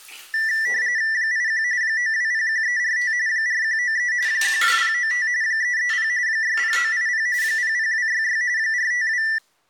RTTY (45.45 baud, 170 Hz shift), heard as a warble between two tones, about 1850 Hz centre, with the noise of a restroom. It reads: 81 9201345 4193 12095 330 60980 00266 452